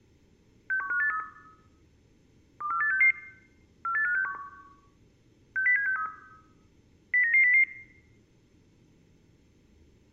Five-tone selective call (CCIR), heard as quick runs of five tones, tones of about 100 ms, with room echo. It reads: 61583 24866 48561 60763 09900